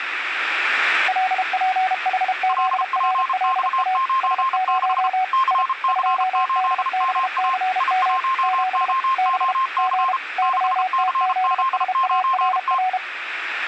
Morse code, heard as two keyed tones, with radio static. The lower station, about 32 wpm, 750 Hz: LPHZRLA S0 I 2DBCM 7 B G YTZSARR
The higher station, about 33 wpm, 1060 Hz: LPX96 CC8MA I1OOC 6CZ9T